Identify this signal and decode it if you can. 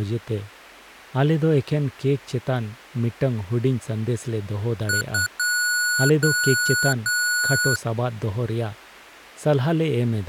Beep code, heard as beeps from a small speaker, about 1460 Hz, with speech in Santali. 2 short, 3 long.